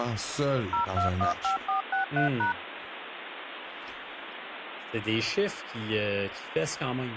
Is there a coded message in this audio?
Yes: DTMF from 0.7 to 2.5 s, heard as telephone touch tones, dialled by machine, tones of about 120 ms, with phone line noise and speech in French. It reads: 0215463#